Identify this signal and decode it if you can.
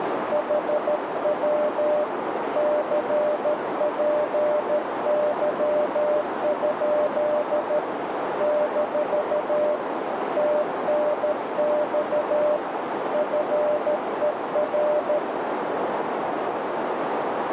Morse code, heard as a keyed tone, hand-sent with a paddle, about 13 wpm, 600 Hz, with heavy radio static and a narrow filter. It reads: HW CPY? - TNX FER